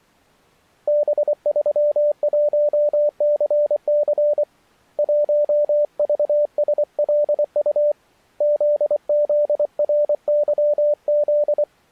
Morse code, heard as a keyed tone, hand-sent with a paddle, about 24 wpm, 590 Hz. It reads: B31CC 1VSLU ZZRYZ